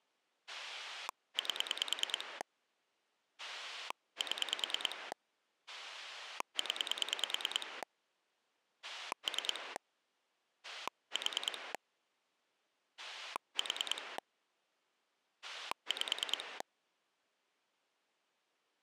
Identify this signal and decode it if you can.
Pulse dialling, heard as a rotary dial, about 9 pulses a second. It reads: 8 7 0 3 4 4 5